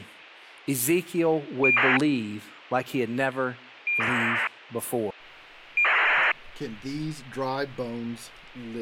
ACARS aircraft data, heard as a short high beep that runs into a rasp, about 2400 baud, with speech in English.